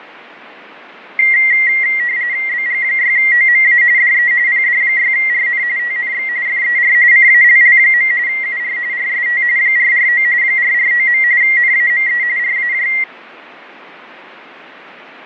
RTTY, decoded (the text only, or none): BG6OMA DE PD6RN TNX FER CALL. UR RST 449 449. NAME RAJ